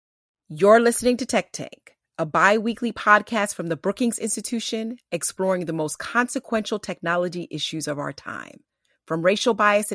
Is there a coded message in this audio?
No, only speech in English.